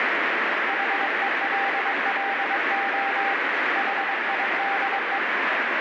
Morse code, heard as a keyed tone, hand-sent with a paddle, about 22 wpm, 790 Hz, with heavy radio static. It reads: HELLO HIDE